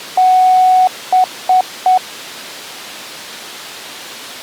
Beep code, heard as beeps, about 740 Hz. 1 long, 3 short. In Award and IBM BIOS tables: video adapter failure; in AMI BIOS tables: memory failure.